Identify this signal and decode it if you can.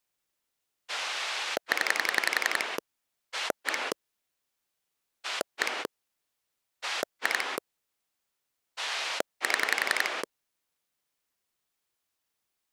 Pulse dialling, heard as a rotary dial, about 11 pulses a second. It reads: 0 1 1 2 7